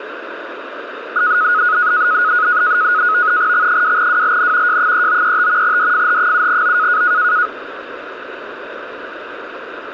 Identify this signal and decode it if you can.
NAVTEX (SITOR-B), 100 baud, 170 Hz shift, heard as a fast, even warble, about 1360 Hz centre, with radio static. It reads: X2WLN J3935 DFH7O